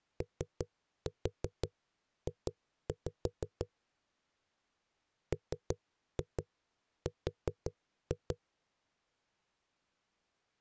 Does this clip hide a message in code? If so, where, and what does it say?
Yes: tap code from 0.2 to 8.4 s, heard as knocks on a wall, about 5 knocks a second. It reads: OJ MR